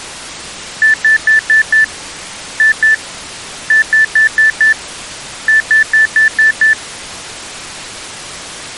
Beep code, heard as beeps, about 1750 Hz. 5-2-5-6.